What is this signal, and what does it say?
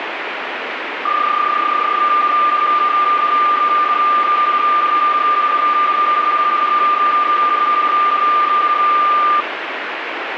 PSK31 (31.25 baud), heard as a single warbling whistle, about 1200 Hz, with radio static.